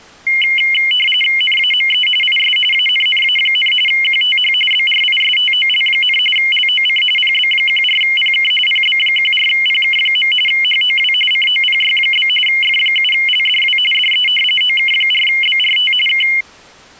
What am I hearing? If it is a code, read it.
RTTY (45.45 baud, 850 Hz shift), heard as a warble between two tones, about 2550 Hz centre. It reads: NAME IS ANNA, QTH BRISTOL, LOC PB14PK PB14PK. HOW COPY? F7LDW DE OK4BRT K